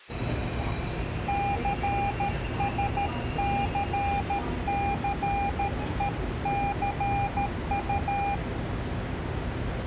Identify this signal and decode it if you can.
Morse code, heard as a keyed tone, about 13 wpm, 800 Hz, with the noise inside a subway train. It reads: CSCCECU